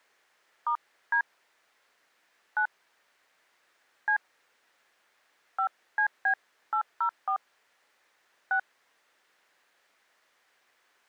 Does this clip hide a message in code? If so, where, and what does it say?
Yes: DTMF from 0.7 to 8.6 s, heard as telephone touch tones, dialled by hand, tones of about 90 ms. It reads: *D 9 C 5CB804 6